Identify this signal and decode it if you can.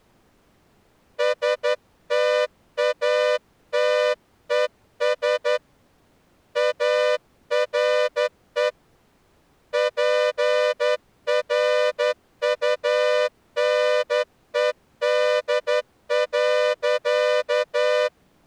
Morse code, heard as a horn, hand-sent with a straight key, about 11 wpm. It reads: STATES ARE PRUNED.